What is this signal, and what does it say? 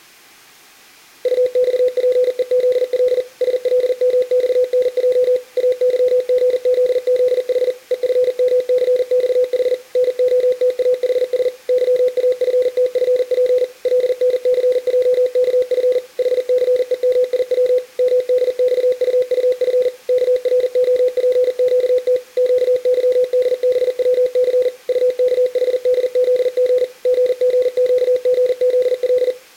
Morse code, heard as a keyed tone, machine-sent, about 40 wpm, 500 Hz. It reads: UXPEZL SLMXNJ AYGZZH EFMCXH NOTAHS YAFTFP LNCJKF HCEMIW MDXUUF KROPQT QYDBWC UKHDZG GGQGZL